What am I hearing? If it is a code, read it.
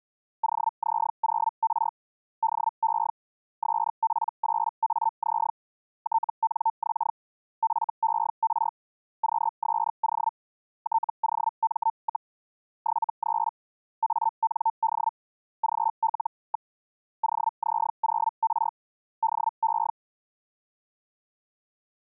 Hellschreiber (Feld-Hell, 122.5 baud), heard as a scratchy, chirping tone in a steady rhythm, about 900 Hz. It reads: OZ0R DE SP8AZ TNX FER QSO TOM, 73 AND GL. OZ0R DE